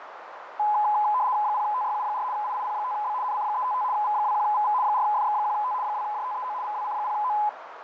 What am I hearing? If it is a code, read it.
RTTY (75 baud, 170 Hz shift), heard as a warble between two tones, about 920 Hz centre, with radio static, fading and a narrow filter. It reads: 0TYU4 IIP5B NC355 V21VV 4FX1T 2JTEO VWC0O